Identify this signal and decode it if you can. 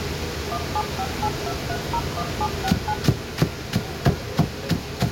DTMF, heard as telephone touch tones, dialled by machine, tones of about 60 ms, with room echo and kitchen noise. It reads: 17582301769